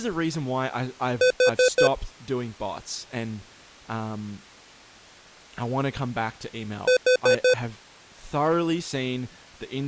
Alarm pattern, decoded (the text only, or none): temporal four